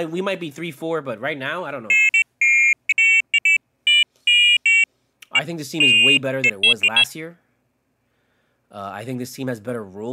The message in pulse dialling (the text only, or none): none